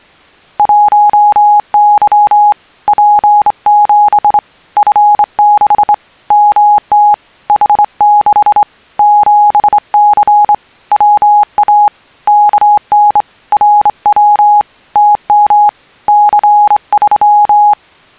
Morse code, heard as a keyed tone, hand-sent with a straight key, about 25 wpm, 830 Hz. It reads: 1Y P7 F6 MT H6 7C WA KN RW TM C3